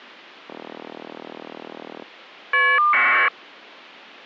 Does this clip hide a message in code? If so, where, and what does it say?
Yes: caller ID data burst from 0.5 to 3.3 s, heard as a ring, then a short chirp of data, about 1200 baud.